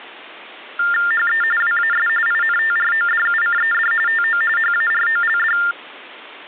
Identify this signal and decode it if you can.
TTY/TDD text telephone tones (45.45 baud Baudot), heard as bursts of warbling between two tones, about 400 Hz shift, 1600 Hz centre. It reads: HE WAS INTRODUCED TO HAROLD